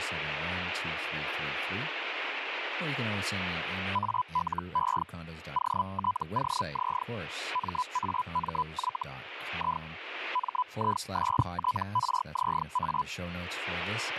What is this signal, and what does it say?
Hellschreiber (Feld-Hell, 122.5 baud), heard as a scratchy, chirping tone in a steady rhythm, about 1000 Hz, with radio static and speech in English. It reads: ALE OTOZ MAMY I MISTRZA